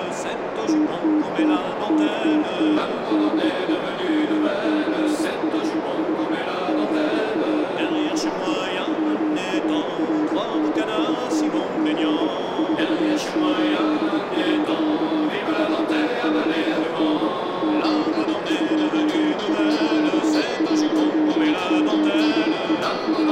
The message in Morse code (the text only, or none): TTT TTT DE MCHH GALE WARNING 48.46N 72.18E …